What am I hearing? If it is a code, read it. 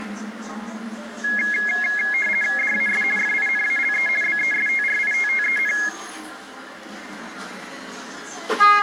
RTTY (50 baud, 450 Hz shift), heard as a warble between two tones, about 1900 Hz centre, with the noise inside a bus. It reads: DAS FINALE BESTRITTEN